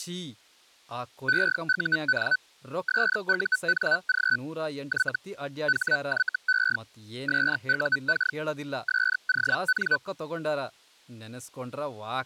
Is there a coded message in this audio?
Yes: Hellschreiber (Feld-Hell, 122.5 baud) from 1.3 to 10.0 s, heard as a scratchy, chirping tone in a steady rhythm, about 1500 Hz, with speech in Kannada. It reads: EUN SUNG Y HYE SUK SON